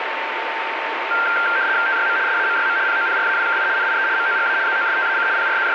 RTTY (75 baud, 170 Hz shift), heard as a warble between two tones, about 1480 Hz centre, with radio static and a steady whistle near 900 Hz. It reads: TYM SAMYM POPRAWKI NIE MOGA ZOSTAC …